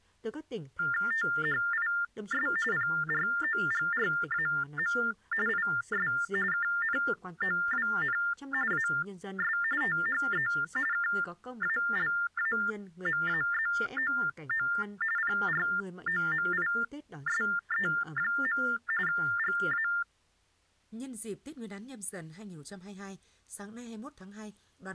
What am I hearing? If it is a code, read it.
TTY/TDD text telephone tones (45.45 baud Baudot), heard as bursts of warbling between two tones, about 400 Hz shift, 1600 Hz centre, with speech in Vietnamese. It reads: THIS PROGRAM IS KNOWN AS THE KALAMAZOO PROMISE. GA